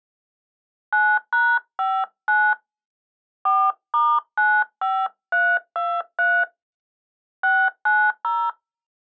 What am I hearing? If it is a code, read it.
DTMF, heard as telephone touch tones, dialled by hand, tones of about 250 ms. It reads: 9#59 4*95323 690